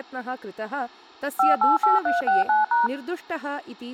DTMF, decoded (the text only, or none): 588369#